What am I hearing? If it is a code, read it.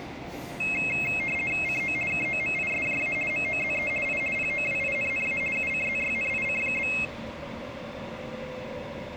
RTTY (50 baud, 450 Hz shift), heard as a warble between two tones, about 2350 Hz centre, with room echo and the noise inside a subway train. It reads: CO KOMISJA MOZE I POWINNA UCZYNIC?